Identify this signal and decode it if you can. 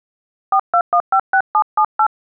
DTMF, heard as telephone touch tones, dialled by hand, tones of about 70 ms. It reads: 42156778